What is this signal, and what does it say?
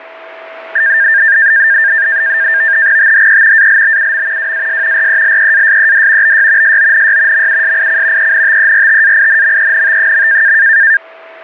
NAVTEX (SITOR-B), 100 baud, 170 Hz shift, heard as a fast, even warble, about 1700 Hz centre, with a steady whistle near 650 Hz. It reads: THE ALBUM WAS RELEASED BY SONY MUSIC ENTERTAINMENT.